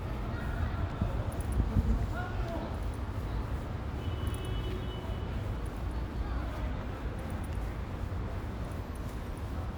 The noise of a residential street. There is no code.